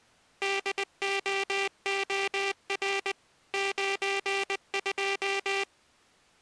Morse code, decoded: DOOR 92

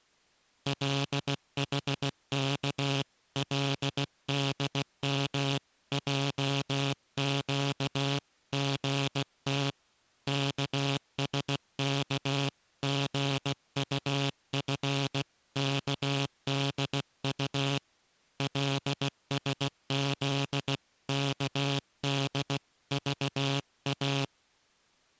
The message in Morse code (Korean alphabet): 궁금해서 영신의 곁으로

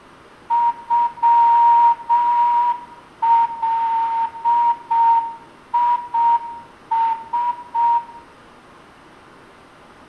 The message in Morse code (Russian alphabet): ЮЛИС

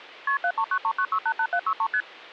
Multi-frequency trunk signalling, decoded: KP 73939688763 ST

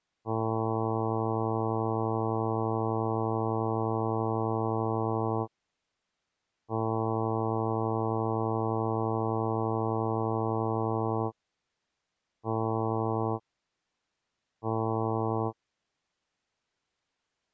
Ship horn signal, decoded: 2 long, 2 short

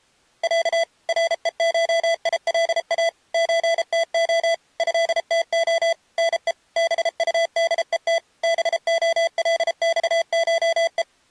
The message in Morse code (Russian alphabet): Я РЕШИЛА ЧТО ЭТО НЕ БУДЕТ БОЛЬШЕ

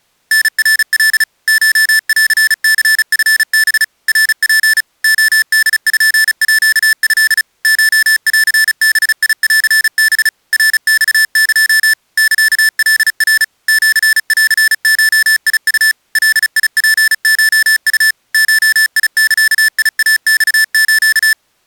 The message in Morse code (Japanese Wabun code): タナカ コンニチハ ナツ レポート コンバンハ ナマエ サカナ シンゴウ ガツコウ ゴザイマス

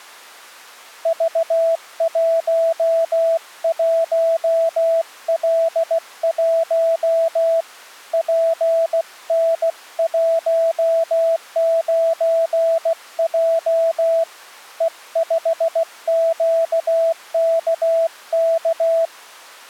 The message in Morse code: V11L1 PN19J E5QKK

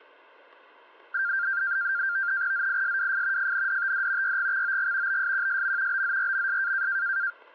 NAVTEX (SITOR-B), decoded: ZISWF FNDTD YGXOG BSQSM BZRMS

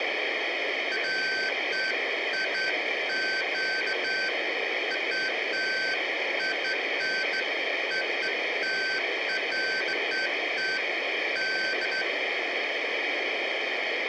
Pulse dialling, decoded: none

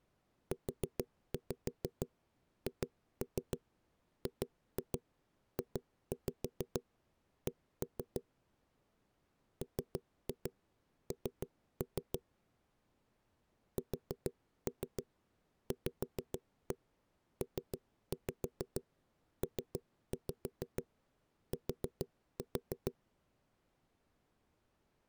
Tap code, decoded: UHGJC MN SVPPT

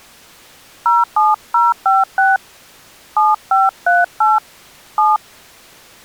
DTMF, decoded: 07056 7538 7

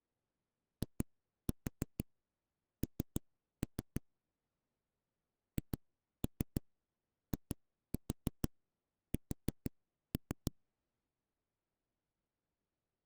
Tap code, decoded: IN HIS

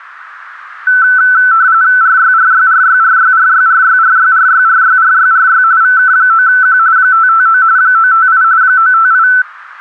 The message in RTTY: RYRYRYRYRYRYRYRYRYRYRY VK9Q 559 958 958

